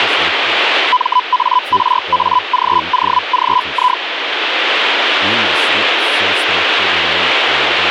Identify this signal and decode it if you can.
Hellschreiber (Feld-Hell, 122.5 baud), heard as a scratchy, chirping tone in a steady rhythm, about 1000 Hz, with radio static. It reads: MARAGOGI